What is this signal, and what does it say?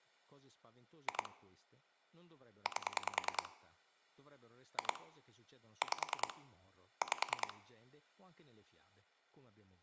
Pulse dialling, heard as clicks on a phone line, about 10 pulses a second, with speech in Italian. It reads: 2 8 2 5 5